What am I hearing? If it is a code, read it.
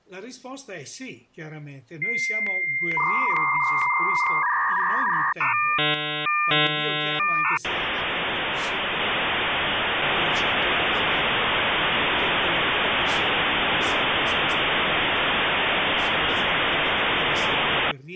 Dial-up modem handshake (V.34 or later), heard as a whistle, warbles, then hiss.